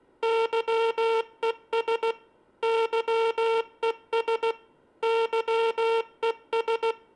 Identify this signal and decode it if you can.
Morse code, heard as a buzzer, machine-sent, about 16 wpm, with room echo. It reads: YES YES YES